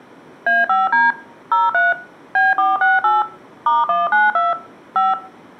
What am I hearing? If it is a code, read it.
DTMF, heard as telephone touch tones, dialled by machine, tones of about 180 ms, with room echo. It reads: A5D 03 B468 *192 5